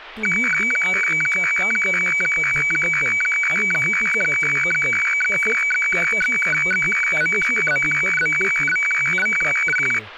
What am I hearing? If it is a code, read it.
Weather fax (radiofax), 120 lines a minute, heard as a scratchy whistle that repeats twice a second, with speech in Marathi.